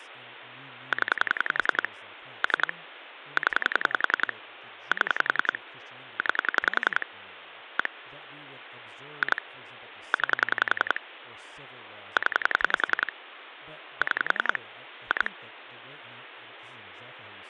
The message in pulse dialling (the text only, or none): 0 3 0 7 9 1 2 9 0 6 2